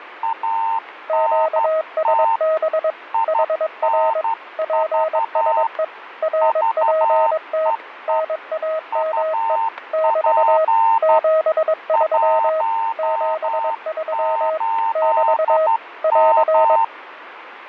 Morse code, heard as two keyed tones, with radio static and fading. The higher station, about 12 wpm, 910 Hz: ANT INV VEE UP 18M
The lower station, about 22 wpm, 630 Hz: QSB HR PSE RPT NAME <BT> 73 73 <BT> <AR>